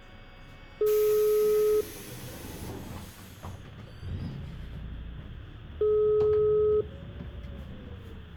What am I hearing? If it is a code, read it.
Telephone call progress tone (single-tone plan, as in most of Europe), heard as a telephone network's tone, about 420 Hz, 1 s on and 4 s off, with room echo and the noise inside a bus. Ringback tone.